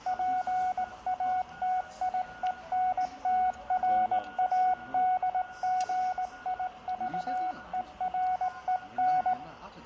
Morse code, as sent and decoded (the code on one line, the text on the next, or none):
.--. .- - .. . -. - .-. .- -.. --. .. ...- . .-. . -.
PATIENTRADGIVEREN